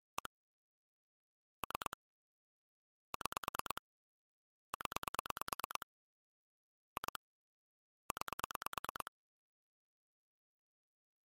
Pulse dialling, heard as clicks on a phone line, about 9 pulses a second. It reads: 1 3 6 0 2 9